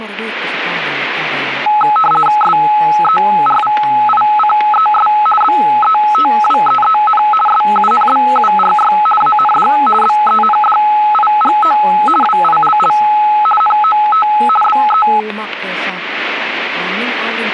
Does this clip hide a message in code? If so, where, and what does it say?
Yes: RTTY (50 baud, 450 Hz shift) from 1.7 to 15.2 s, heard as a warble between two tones, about 1070 Hz centre, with static crashes. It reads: SERVICES BETWEEN SUNBURY AND BENDIGO WILL NOT BE